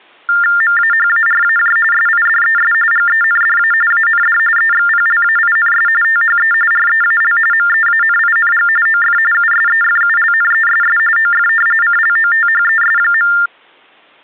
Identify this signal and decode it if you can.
TTY/TDD text telephone tones (45.45 baud Baudot), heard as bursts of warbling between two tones, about 400 Hz shift, 1600 Hz centre. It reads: MAHARAJ SIDES GENDA AND EXPLAINS THE REAL MEANING OF USEFULNESS OF CLOTHES.